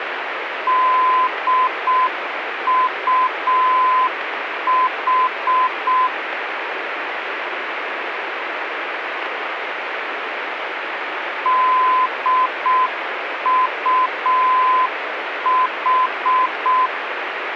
Morse code, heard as a keyed tone, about 6 wpm, 1020 Hz, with radio static. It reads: DUH DUH